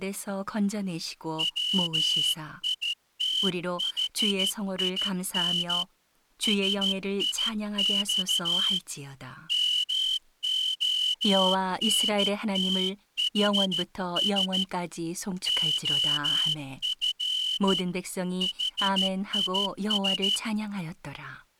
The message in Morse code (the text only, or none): WITHIN SIX MONTHS OF HIS